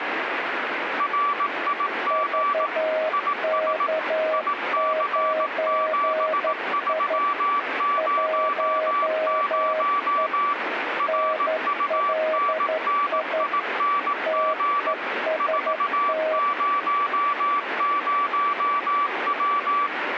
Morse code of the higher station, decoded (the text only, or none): RIG IS IC7300 RUNNING 400W